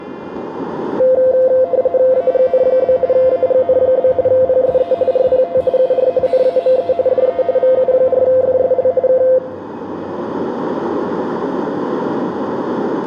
RTTY (45.45 baud, 170 Hz shift), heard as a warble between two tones, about 600 Hz centre, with radio static. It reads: AGN? AGN? PSE RPT UR NAME DE VU4FSL K